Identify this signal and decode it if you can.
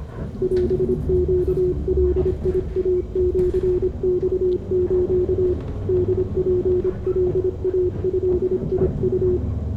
Morse code (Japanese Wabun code), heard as a keyed tone, hand-sent with a paddle, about 26 wpm, 360 Hz, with room echo and the noise inside a bus. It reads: オネガイシマス ホツカイドウ